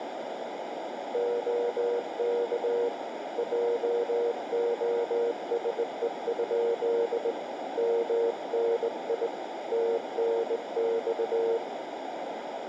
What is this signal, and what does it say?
Morse code, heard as a keyed tone, hand-sent with a straight key, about 19 wpm, 470 Hz, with radio static and a narrow filter. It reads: OK JOSE? MNI TNX